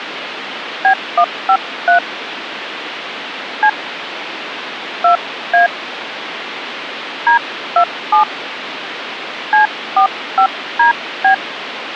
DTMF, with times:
0.8-2.0 B153
3.6-3.7 C
5.0-5.7 2A
7.3-8.2 D27
9.5-11.3 C45DB

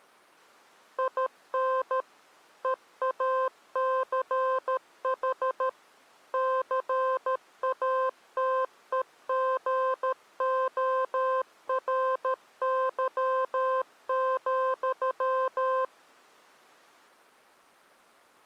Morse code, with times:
1.0-2.0 IN
2.6-5.7 EACH
6.3-15.8 CATEGORY,

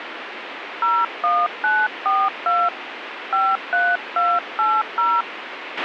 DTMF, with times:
0.8-2.7 01942
3.3-5.2 53280

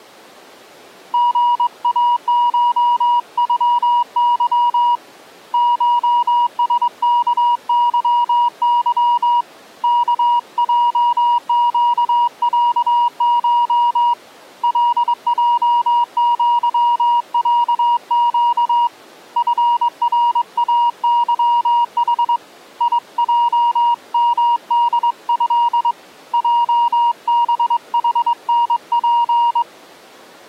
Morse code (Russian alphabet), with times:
1.1-5.0 ГАШЮЫ
5.5-9.4 ШСКЫЫ
9.8-14.1 КЙЩЯШ
14.6-18.9 ЛЙЪЯЩ
19.4-22.4 ФРАЫХ
22.8-25.9 ИЙМДЭ
26.3-29.6 ЙБХНП

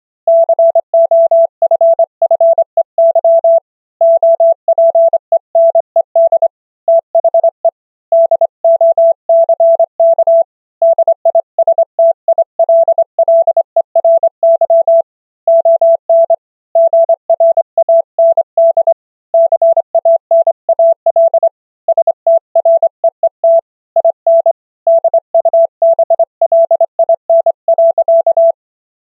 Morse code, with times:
0.3-3.6 COFFEY
4.0-6.5 OPENED
6.9-7.7 THE
8.1-10.4 DOCK
10.8-15.0 DISTILLERY
15.5-16.3 ON
16.8-18.9 GRAND
19.3-21.5 CANAL
21.9-23.6 STREET
24.0-24.5 IN
24.9-28.5 DUBLIN.

